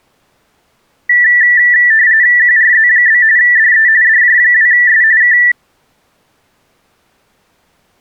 RTTY (45.45 baud, 170 Hz shift), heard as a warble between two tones, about 1850 Hz centre. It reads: QRZ? DE DJ2S K